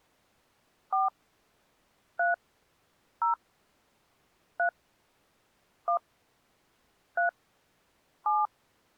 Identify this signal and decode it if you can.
DTMF, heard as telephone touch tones, dialled by hand, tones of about 140 ms. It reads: 4 3 0 3 1 3 7